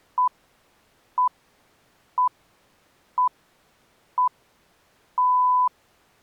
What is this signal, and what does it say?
Radio time signal (six pips, as the Greenwich Time Signal), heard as pips.